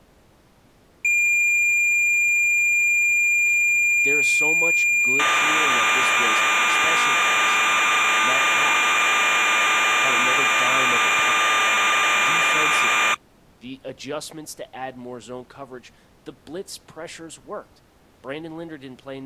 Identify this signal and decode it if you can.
Cassette data (Kansas City type), 1200 baud, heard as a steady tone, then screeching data, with speech in English.